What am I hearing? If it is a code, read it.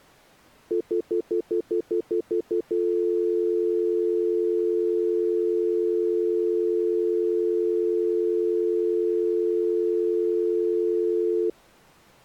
Telephone call progress tone (North American plan), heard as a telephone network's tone, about 350, 440 Hz, 0.1 s on and 0.1 s off. Stutter dial tone.